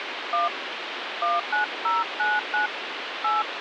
DTMF, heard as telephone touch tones, dialled by hand, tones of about 170 ms, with phone line noise. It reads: 1 19099 8